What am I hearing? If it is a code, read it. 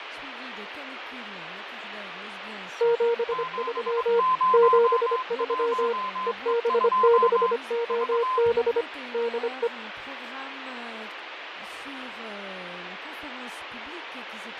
Morse code, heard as two keyed tones, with radio static and fading. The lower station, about 25 wpm, 470 Hz: 73 73 EB6OB DE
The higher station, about 22 wpm, 1030 Hz: 701E2 V